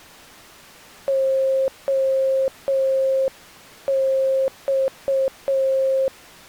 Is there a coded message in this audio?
Yes: Morse code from 1.0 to 6.1 s, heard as a keyed tone, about 6 wpm, 530 Hz. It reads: OX